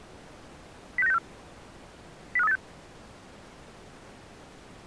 Five-tone selective call (EEA), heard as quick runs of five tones, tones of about 40 ms. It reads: 06964 05386